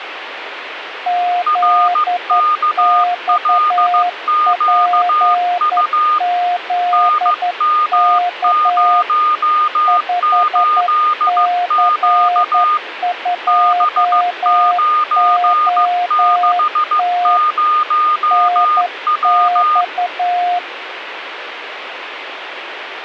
Morse code, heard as two keyed tones, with radio static. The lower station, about 11 wpm, 710 Hz: ZXPZK 5C2OT NX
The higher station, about 15 wpm, 1220 Hz: RKLQU NM08Q B960W